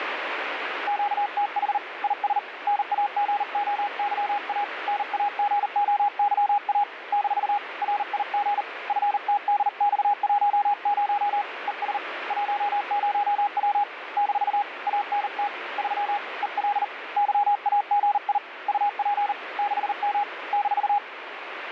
Morse code, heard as a keyed tone, hand-sent with a paddle, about 39 wpm, 820 Hz, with radio static. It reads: QTH IS NAGOYA NAGOYA - RIG FTDX10 ES 10W - ANT 3 EL YAGI UP 6M -